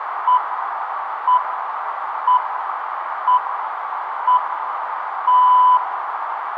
Radio time signal (six pips, as the Greenwich Time Signal), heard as pips, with radio static, a narrow filter and room echo.